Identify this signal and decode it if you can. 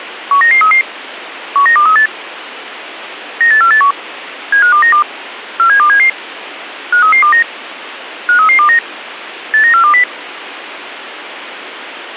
Five-tone selective call (CCIR), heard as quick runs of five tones, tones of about 100 ms, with radio hiss. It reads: 19933 19238 98481 75292 47277 53329 53329 89420